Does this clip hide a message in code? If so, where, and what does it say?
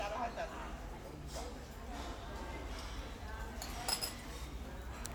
No, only the noise of a restaurant.